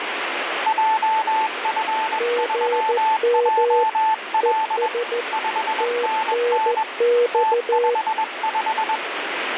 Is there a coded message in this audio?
Yes: Morse code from 0.6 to 9.0 s, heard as two keyed tones, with radio static. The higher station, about 21 wpm, 880 Hz: JF3JL 5NN T55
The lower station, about 14 wpm, 480 Hz: GM ES TNX